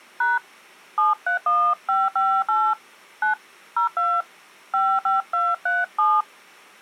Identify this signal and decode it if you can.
DTMF, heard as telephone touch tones, dialled by hand, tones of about 200 ms. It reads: # 731558 9 02 55237